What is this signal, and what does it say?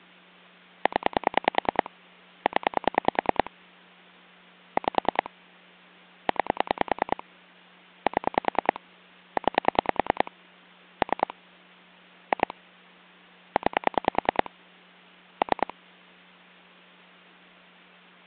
Pulse dialling, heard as clicks on a phone line, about 10 pulses a second. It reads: 0 0 5 9 7 9 3 2 9 3